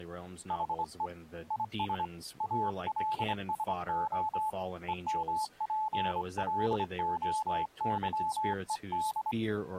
Morse code, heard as a keyed tone, hand-sent with a straight key, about 25 wpm, 870 Hz, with speech in English. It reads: HE IS ALSO EMPLOYED